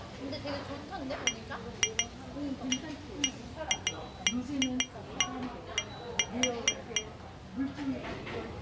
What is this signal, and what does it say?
Irregular taps on glass, with the noise of a restaurant. There is no code.